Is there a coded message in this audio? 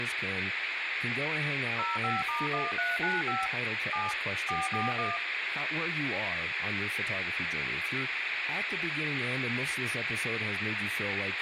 Yes: DTMF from 1.8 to 5.2 s, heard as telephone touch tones, dialled by machine, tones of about 180 ms, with radio hiss, a squelch burst at the end and speech in English. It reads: 05*1395 7 441